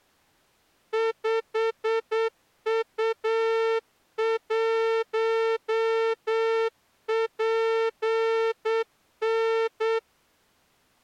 Morse code, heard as a horn, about 8 wpm. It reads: 5U1PN